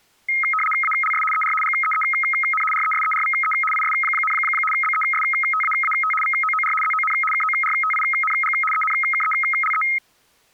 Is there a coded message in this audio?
Yes: RTTY (75 baud, 850 Hz shift) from 0.3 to 10.0 s, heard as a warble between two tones, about 1700 Hz centre. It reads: ALS ER GEEN RESERVE IS, BESTAAT VOOR ZON KORTING ENKELE